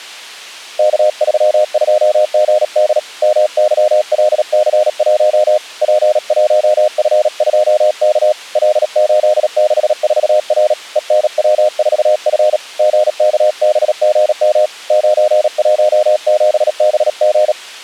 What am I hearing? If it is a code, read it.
Morse code, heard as a keyed tone, hand-sent with a paddle, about 37 wpm, 610 Hz. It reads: K32GD MYLC1 P1F2K L864R ENW4F GKBGM 917BG